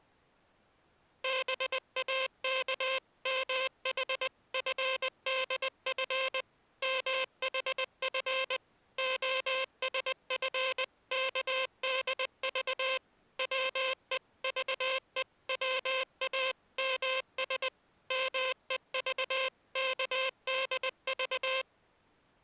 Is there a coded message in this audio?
Yes: Morse code (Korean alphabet) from 1.2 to 21.7 s, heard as a buzzer, machine-sent, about 20 wpm. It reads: 동무는 문 편을 바라보며 말을